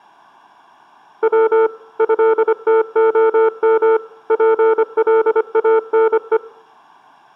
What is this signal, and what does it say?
Morse code (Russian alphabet), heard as a keyed tone, machine-sent, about 25 wpm, 450 Hz, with room echo. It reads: В ЭТОМ ПЛАНЕ